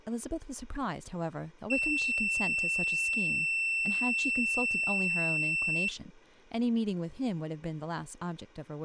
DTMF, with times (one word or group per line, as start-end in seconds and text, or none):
none